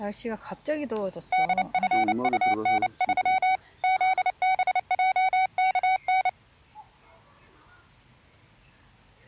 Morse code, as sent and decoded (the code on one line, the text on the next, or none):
-.. ..-. ..- -. ...-- / --.. -... .--- -.- -.
DFUN3 ZBJKN